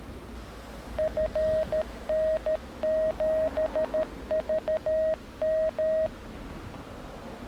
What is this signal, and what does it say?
Morse code, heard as a keyed tone, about 13 wpm, 630 Hz, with the noise of a residential street. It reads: FN7VM